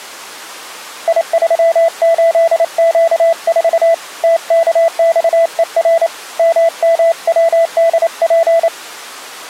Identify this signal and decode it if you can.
Morse code, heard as a keyed tone, hand-sent with a paddle, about 28 wpm, 660 Hz. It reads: I38Q4 TKXER MMWDP